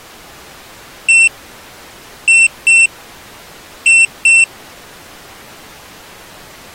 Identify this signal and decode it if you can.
Beep code, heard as a piezo beeper, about 2700 Hz. 1-2-2. In Phoenix BIOS tables: DMA initialisation failure.